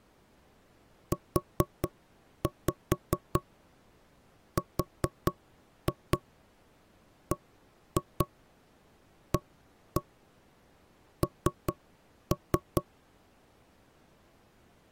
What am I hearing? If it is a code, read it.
Tap code, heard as knocks on wood, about 4 knocks a second. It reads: URBAN